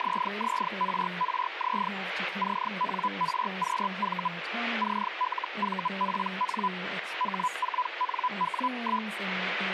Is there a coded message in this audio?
Yes: Hellschreiber (Feld-Hell, 122.5 baud) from 0.0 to 9.1 s, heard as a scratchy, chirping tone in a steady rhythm, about 1000 Hz, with radio static and speech in English. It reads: ZZRRZ CNRQV CLVPN H4NW1